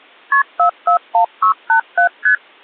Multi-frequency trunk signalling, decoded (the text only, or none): KP 441687 ST